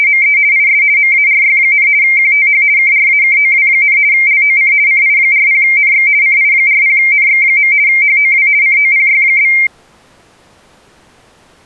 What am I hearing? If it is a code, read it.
RTTY (50 baud, 170 Hz shift), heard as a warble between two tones, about 2200 Hz centre. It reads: … IS MARY, QTH KRAKOW, LOC CI40NX CI40NX. HOW COPY?